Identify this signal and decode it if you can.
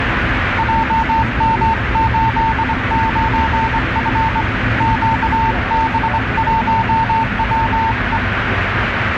Morse code, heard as a keyed tone, hand-sent with a straight key, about 23 wpm, 900 Hz, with radio static and the noise inside a subway train. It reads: JM89F QB1WE